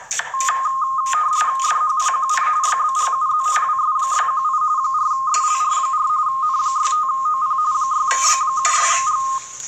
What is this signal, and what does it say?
RTTY (45.45 baud, 170 Hz shift), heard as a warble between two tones, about 1150 Hz centre, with kitchen noise. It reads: DHPQC YBGUZ WS618 4SLR4 N65OP 6B76G